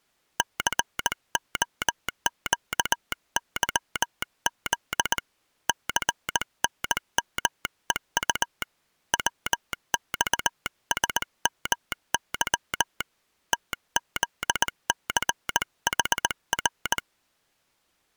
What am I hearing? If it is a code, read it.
Morse code, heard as a telegraph sounder, hand-sent with a paddle, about 19 wpm. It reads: COQYZ CNMEU WXSMY TZCHR